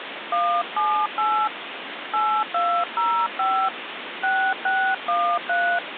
DTMF, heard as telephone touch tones, dialled by hand, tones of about 290 ms, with phone line noise. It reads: 178 8205 6613